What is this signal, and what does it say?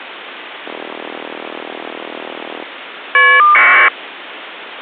Caller ID data burst, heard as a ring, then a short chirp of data, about 1200 baud, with phone line noise.